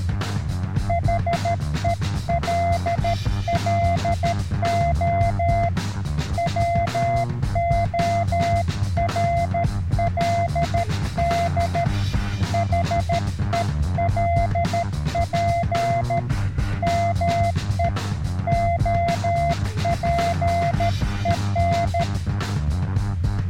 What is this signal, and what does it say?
Morse code, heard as a keyed tone, hand-sent with a paddle, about 13 wpm, 690 Hz. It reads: HELLO WORLD HELP ME OPEN